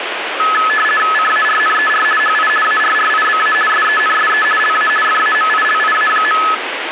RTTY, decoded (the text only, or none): CARNER HI ARRIBA SENSE LA FAMILIA.